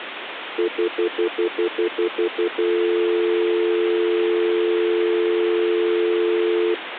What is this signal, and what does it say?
Telephone call progress tone (North American plan), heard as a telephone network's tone, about 350, 440 Hz, 0.1 s on and 0.1 s off, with phone line noise. Stutter dial tone.